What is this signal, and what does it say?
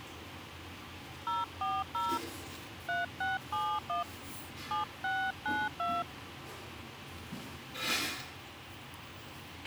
DTMF, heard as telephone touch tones, dialled by hand, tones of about 200 ms, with a squelch burst at the end and the noise of a restaurant. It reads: 040 3671 7692